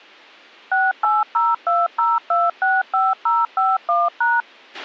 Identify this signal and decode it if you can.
DTMF, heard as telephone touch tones, dialled by machine, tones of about 200 ms, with a squelch burst at the end. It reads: 68020265051#